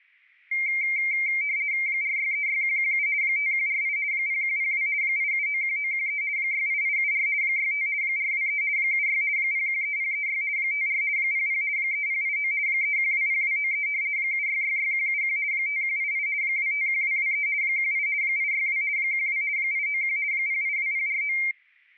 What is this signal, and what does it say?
RTTY (50 baud, 170 Hz shift), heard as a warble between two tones, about 2200 Hz centre. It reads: 4636117 5148 0102 8791913 68874 65 423 76 013036 54 00 3089 3120293 7666171 5188 251223 18 862 12 891 082049